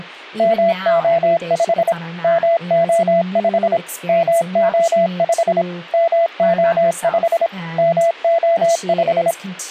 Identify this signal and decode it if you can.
Morse code, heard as a keyed tone, machine-sent, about 26 wpm, 670 Hz, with speech in English. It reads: MO5 MO5 MO5 MO5 MO5